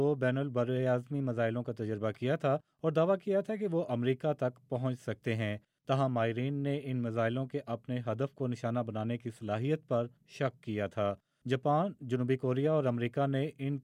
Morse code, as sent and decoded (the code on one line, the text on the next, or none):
none